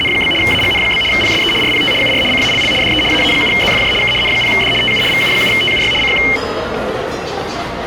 RTTY (75 baud, 850 Hz shift), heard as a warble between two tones, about 2550 Hz centre, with static crashes and the noise of a restaurant. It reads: … AGN? PSE RPT UR CALL DE AA7ZFJ K N0D TU VU7TUY CQ